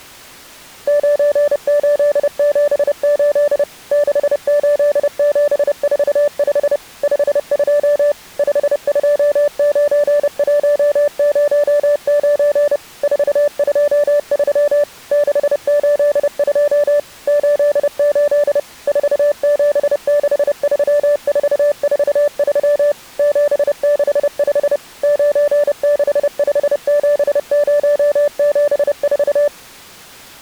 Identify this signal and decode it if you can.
Morse code, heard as a keyed tone, machine-sent, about 30 wpm, 580 Hz. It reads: 9878 68745 52 529109 423 682 88 4763443 765 9657074